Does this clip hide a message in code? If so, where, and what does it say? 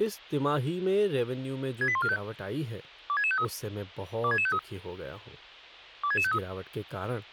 Yes: five-tone selective call (ZVEI) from 1.8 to 6.4 s, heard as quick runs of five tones, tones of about 70 ms, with speech in Hindi. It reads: 68145 26653 26653 26653